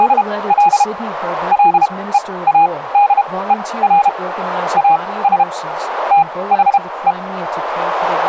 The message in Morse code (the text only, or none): … LEADER AS THE